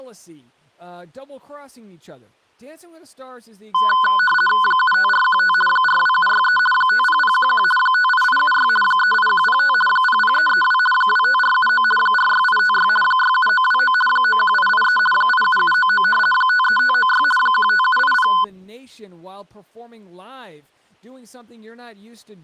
RTTY (50 baud, 450 Hz shift), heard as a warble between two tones, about 1250 Hz centre, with speech in English. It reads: 75415 42763 50011 58876 38105 00332 25479 46856 67929 91883 87799 53596 15780